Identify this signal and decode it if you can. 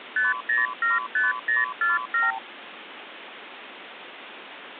Multi-frequency trunk signalling (R2, with the far end's replies), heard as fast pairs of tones, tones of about 160 ms, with phone line noise. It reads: 5075047